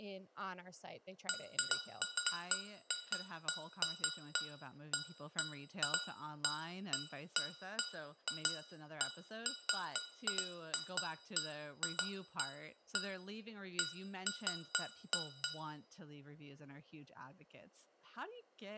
Irregular taps on glass, with room echo and speech in English. There is no code.